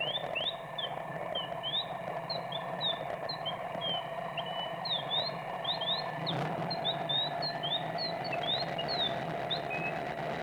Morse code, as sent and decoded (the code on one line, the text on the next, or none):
none